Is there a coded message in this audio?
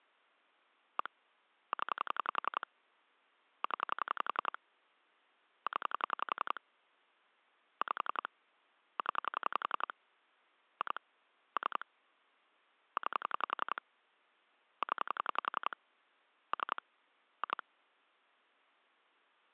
Yes: pulse dialling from 1.0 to 17.6 s, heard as clicks on a phone line, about 11 pulses a second. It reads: 1 0 0 0 5 0 2 3 9 0 3 2